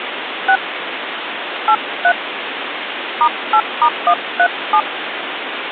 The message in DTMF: 6 83 *8*137

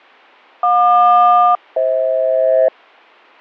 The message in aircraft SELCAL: JQ-FH

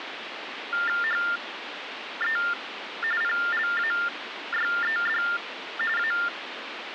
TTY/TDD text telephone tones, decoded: HE PLAYED A

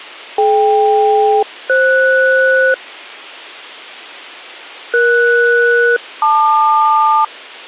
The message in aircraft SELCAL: DK-FS ES-LQ

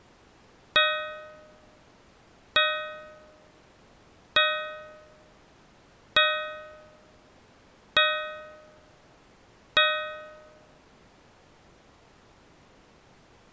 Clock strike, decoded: 6

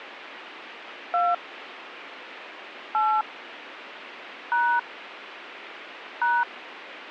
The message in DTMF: 2 8 # #

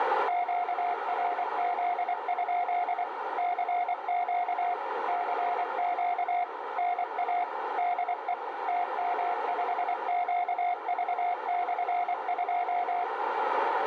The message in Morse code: QRZ? CQ CQ NA DE TM5QV/2

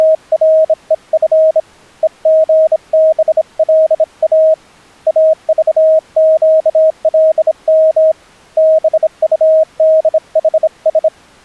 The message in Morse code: … EGBLA AVQLM BUDHS

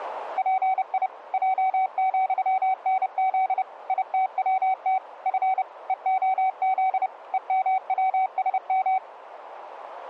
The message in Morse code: PI J,NZ ITWT F EOZ EMWSM

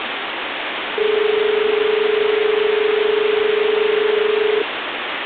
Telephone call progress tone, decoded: dial tone

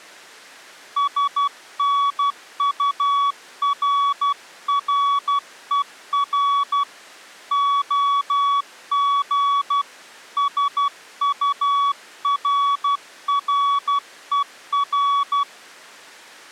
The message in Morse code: SNURRER OG SURRER

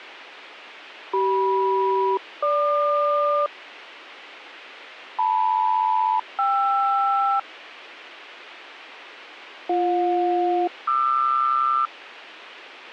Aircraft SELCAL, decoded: CM-GQ LM-KR BJ-QR

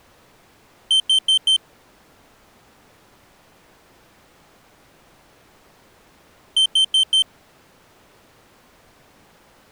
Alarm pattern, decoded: temporal four

